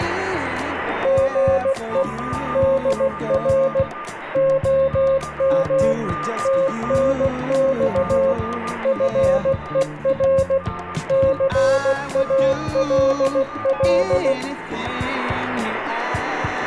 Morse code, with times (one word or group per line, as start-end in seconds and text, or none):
1.1-2.0 GE
2.6-3.8 DR
4.4-5.9 OM
6.5-8.3 TNX
8.9-10.6 FER
11.1-14.3 CALL